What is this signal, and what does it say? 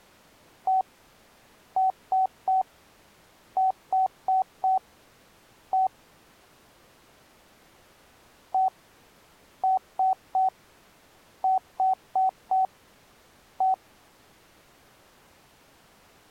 Beep code, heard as beeps, played twice, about 760 Hz. 1-3-4-1. In Phoenix BIOS tables: memory failure on an address line.